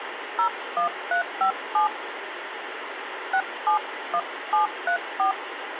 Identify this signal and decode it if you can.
DTMF, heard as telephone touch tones, dialled by hand, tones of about 100 ms, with phone line noise. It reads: 01357 671734